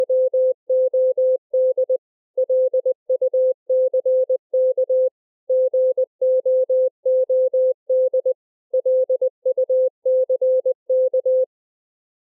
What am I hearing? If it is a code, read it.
Morse code, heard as a keyed tone, machine-sent, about 20 wpm, 520 Hz. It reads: … LUCK GOOD LUCK